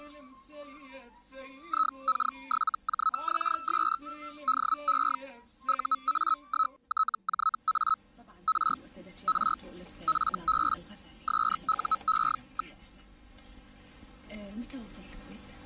Hellschreiber (Feld-Hell, 122.5 baud), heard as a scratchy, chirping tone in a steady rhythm, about 1290 Hz. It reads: IK7JXS DE UA1TJA R R FB SUE.